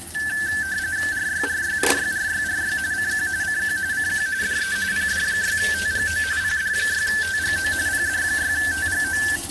RTTY (45.45 baud, 170 Hz shift), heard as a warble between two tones, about 1650 Hz centre, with radio static and kitchen noise. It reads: RYRYRYRYRY CQ CQ CQ DE PD6TGO PD6TGO PD6TGO